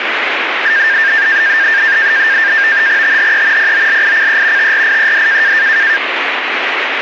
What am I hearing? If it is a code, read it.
NAVTEX (SITOR-B), 100 baud, 170 Hz shift, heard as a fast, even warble, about 1700 Hz centre, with radio static. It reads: THE POLICE TRIED